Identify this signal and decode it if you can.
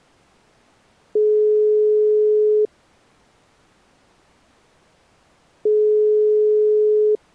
Telephone call progress tone (single-tone plan, as in most of Europe), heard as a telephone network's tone, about 420 Hz, 1.5 s on and 3 s off. Ringback tone.